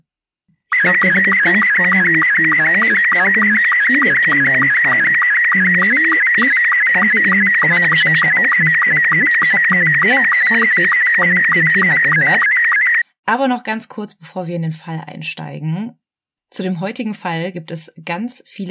SSTV (slow-scan television), Robot 72, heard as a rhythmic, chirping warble, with speech in German.